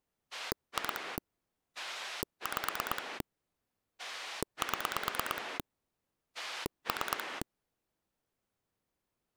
Pulse dialling, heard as a rotary dial, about 9 pulses a second. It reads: 2 5 7 3